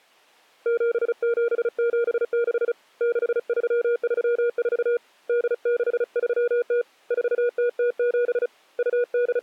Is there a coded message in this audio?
Yes: Morse code (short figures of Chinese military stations) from 0.6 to 9.4 s, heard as a keyed tone, hand-sent with a paddle, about 35 wpm, 480 Hz. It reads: 7776 6334 8630 4007 …